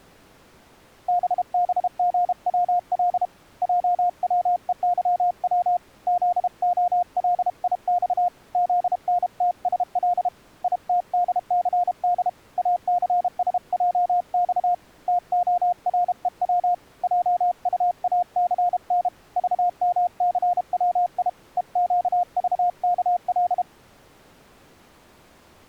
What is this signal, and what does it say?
Morse code, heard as a keyed tone, hand-sent with a paddle, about 32 wpm, 710 Hz. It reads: BBGWL JWEYW ZOLIX ZNTSL ITDCD ACSJX TOREW JUACN VMCWI EQVKL